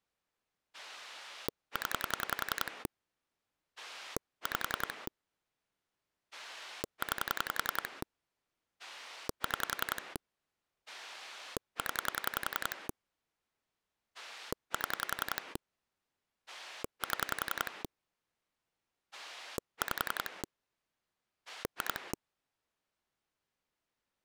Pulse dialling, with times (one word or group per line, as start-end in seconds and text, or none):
0.7-2.9 0
3.8-5.1 5
6.3-8.0 9
8.8-10.2 6
10.9-12.9 0
14.1-15.6 7
16.5-17.8 7
19.1-20.4 5
21.5-22.1 2